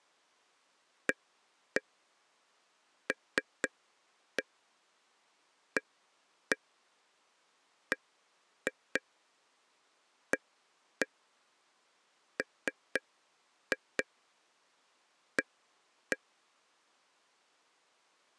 Tap code, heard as taps on a table, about 4 knocks a second. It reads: ALABAMA